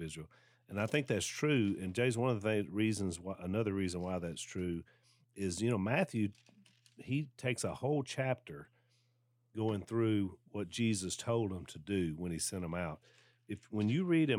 Speech in English. There is no code.